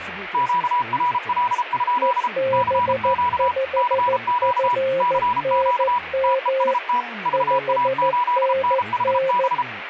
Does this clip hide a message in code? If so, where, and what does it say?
Yes: Morse code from 0.3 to 9.7 s, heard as two keyed tones, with radio static and speech in Korean. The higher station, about 33 wpm, 980 Hz: QRL? CQ CQ CQ TEST VA8NHB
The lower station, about 14 wpm, 530 Hz: EB5FNM 5NN